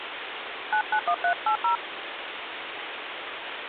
DTMF, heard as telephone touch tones, dialled by hand, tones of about 90 ms, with phone line noise. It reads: 991380